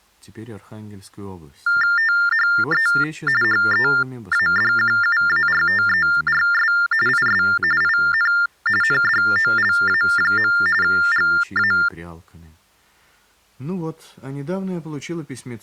TTY/TDD text telephone tones (45.45 baud Baudot), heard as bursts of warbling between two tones, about 400 Hz shift, 1600 Hz centre. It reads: THE HEADQUARTERS IS IN NDOLA. GA